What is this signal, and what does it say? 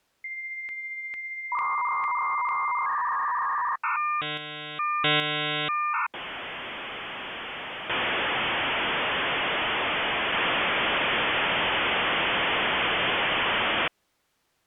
Dial-up modem handshake (V.34 or later), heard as a whistle, warbles, then hiss.